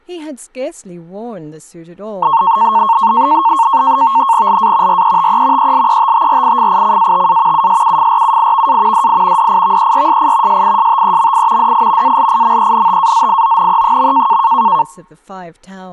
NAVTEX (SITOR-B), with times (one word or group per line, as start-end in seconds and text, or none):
4.5-5.0 LA
4.9-5.7 RETE
5.6-7.7 ELETTRIFICATA
7.5-9.1 USUFRUIVA
8.9-9.5 DI
9.4-10.6 DIVERSI
10.5-11.7 SISTEMI
11.6-12.2 DI
12.0-14.4 ALIMENTAZIONE.